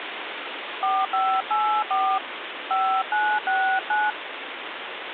DTMF, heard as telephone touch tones, dialled by hand, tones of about 260 ms, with phone line noise. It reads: 4584 5969